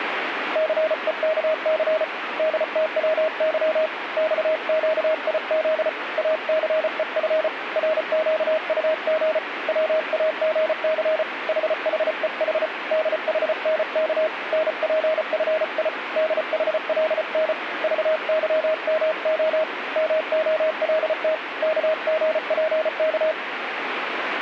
Morse code, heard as a keyed tone, hand-sent with a paddle, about 34 wpm, 630 Hz, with radio static. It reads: CEKC DTWY XQIZ ACEF RQUG WAGC HHEH DHNK NPFI DHLN VYMO MOLT KGPK